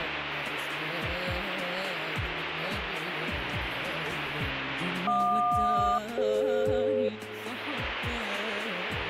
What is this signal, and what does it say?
Aircraft SELCAL, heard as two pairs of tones. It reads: JQ-DF